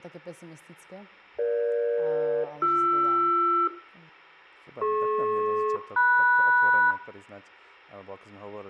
Aircraft SELCAL, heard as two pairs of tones, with room echo and speech in Slovak. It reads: EG-BR DP-MS